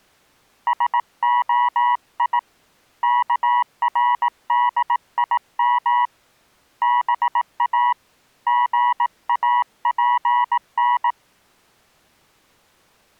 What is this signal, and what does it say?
Morse code (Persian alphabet), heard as a keyed tone, hand-sent with a paddle, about 18 wpm, 970 Hz. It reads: سعی کردیم با ژاپن